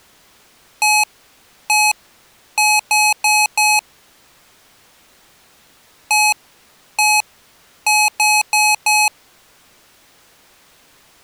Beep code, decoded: 1-1-4

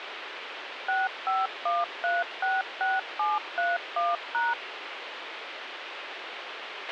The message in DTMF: 651366731#

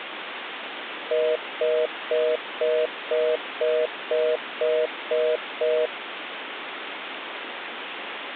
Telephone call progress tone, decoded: congestion tone

